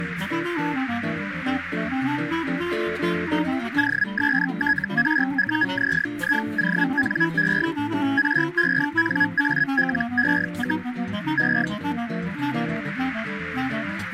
Hellschreiber (Feld-Hell, 122.5 baud), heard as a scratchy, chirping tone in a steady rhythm, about 1650 Hz, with radio static. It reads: OSTRUZIONE RENALE, E